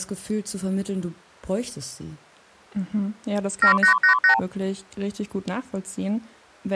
Multi-frequency trunk signalling (R2, with the far end's replies), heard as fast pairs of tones, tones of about 100 ms, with speech in German. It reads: 7888